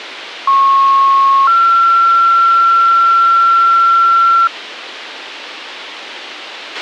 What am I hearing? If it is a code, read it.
Two-tone page, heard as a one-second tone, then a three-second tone, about 1090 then 1360 Hz, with radio hiss and a squelch burst at the end.